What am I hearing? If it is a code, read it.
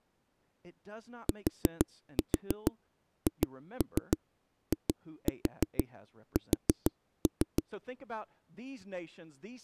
Tap code, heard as knocks on a wall, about 6 knocks a second, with speech in English. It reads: THIS